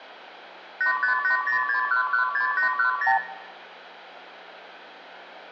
Multi-frequency trunk signalling (R2, with the far end's replies), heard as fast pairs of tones, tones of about 110 ms, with room echo. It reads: 85806116810